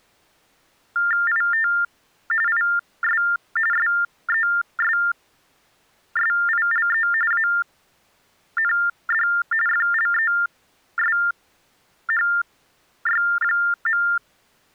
TTY/TDD text telephone tones (45.45 baud Baudot), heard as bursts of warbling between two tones, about 400 Hz shift, 1600 Hz centre. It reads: IT IS SESSILE AND FLESHY.